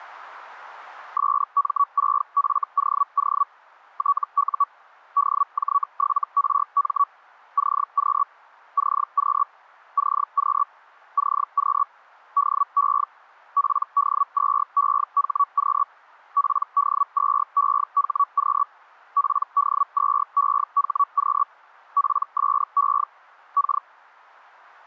Hellschreiber (Feld-Hell, 122.5 baud), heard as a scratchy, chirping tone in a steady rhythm, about 1130 Hz. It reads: SM6FOO TU DJ7RM CQ CQ CQ CQ DE PD2EHQ PD2EHQ PD2EHQ PSE K